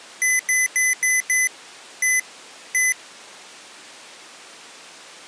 Beep code, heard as beeps from a small speaker, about 2000 Hz. 5-1-1.